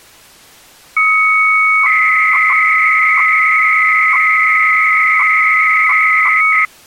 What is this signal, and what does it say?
300-baud modem data (Bell 103 tones), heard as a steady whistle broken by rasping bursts, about 300 baud, 200 Hz shift.